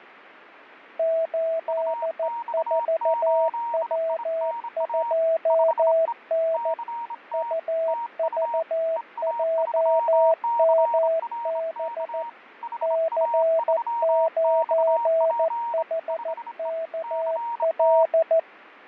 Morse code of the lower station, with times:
1.0-6.7 84W2N
7.3-12.2 UVJMB
12.8-18.4 C9HKL

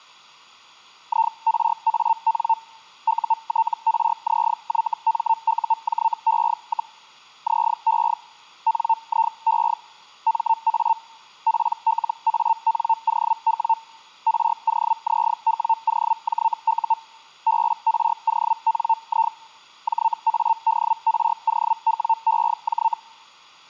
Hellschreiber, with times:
1.1-2.5 IRAN
3.1-6.9 UTRZYMUJE,
7.5-8.1 ZE
8.7-9.7 NIE
10.3-10.9 MA
11.5-13.7 PLANOW
14.3-16.9 ROZWOJU
17.5-19.3 BRONI
19.9-22.9 JADROWEJ

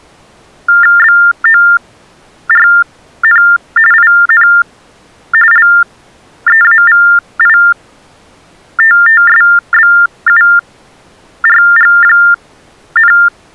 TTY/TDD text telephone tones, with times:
1.0-3.4 BORN
3.9-4.5 IN
5.5-13.1 LEAVITTSBURG,

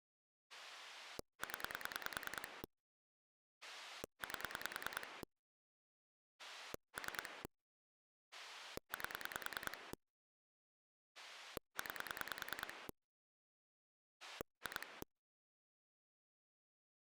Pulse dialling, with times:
0.5-2.6 0
3.6-5.2 8
6.4-7.4 3
8.3-9.9 8
11.2-12.9 9
14.2-15.0 2

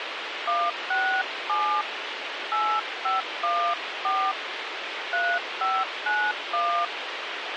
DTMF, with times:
0.5-1.8 167
2.5-4.3 8514
5.1-6.9 3591

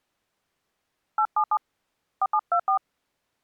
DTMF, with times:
1.2-1.6 877
2.2-2.8 4724

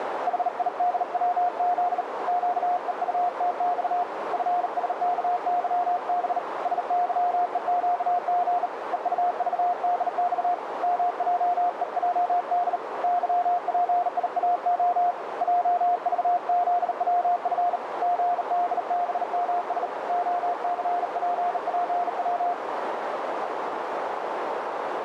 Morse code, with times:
0.3-2.0 HIDWZ
2.3-4.0 QEUTX
4.3-6.4 FSKYB
6.7-8.7 SYEQG
8.9-10.5 EUVDX
10.8-12.8 MJEJD
13.0-15.1 YPIAO
15.4-17.8 JVZWF
18.0-19.9 GDBMS
20.1-22.5 OCPPW

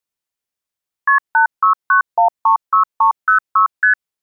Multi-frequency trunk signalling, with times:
1.1-1.2 KP
1.3-3.7 869136306
3.8-3.9 ST

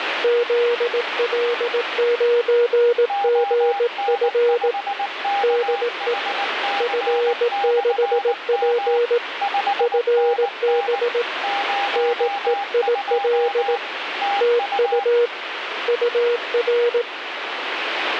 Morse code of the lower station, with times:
0.2-4.7 ZL9GF
5.4-6.1 DE
6.8-9.2 F6P
9.8-11.2 FB
12.0-13.8 NEIL
14.4-15.3 TU
15.9-17.0 UR

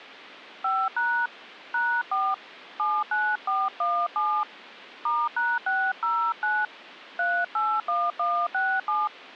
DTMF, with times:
0.6-1.3 5#
1.7-2.3 #4
2.8-4.4 79417
5.1-6.7 *#609
7.2-9.1 381167

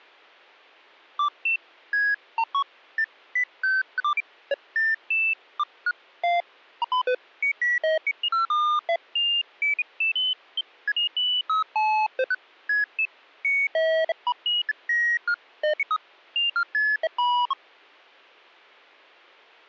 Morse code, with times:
none

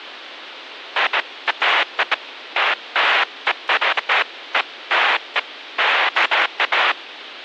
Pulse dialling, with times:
none

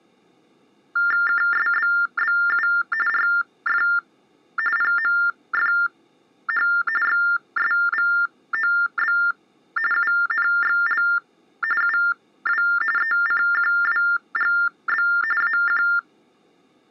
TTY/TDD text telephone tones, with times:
1.3-2.7 KSBBU
3.1-3.8 RF
4.8-6.7 PMFH
7.0-9.2 XSVOB
9.9-11.0 UNXL
11.8-12.6 UW
13.0-15.1 ECQWGB
15.4-15.8 AQ

